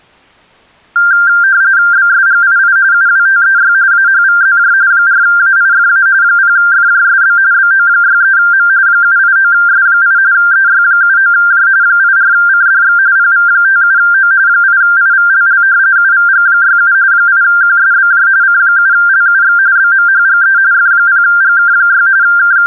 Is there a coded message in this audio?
Yes: RTTY (45.45 baud, 170 Hz shift) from 1.0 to 22.7 s, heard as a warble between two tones, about 1480 Hz centre. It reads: BSGII UWTEY AHVZJ 4AIFA 0FJSB BO63M 789S8 EY79J 84CDX PV57O 8IVLL UVG67 8QSBJ C7LUX BMHGE F0GK6 …